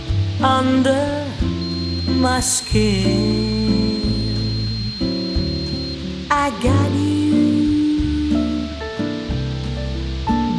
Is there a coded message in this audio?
No, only a steady tone, with radio hiss.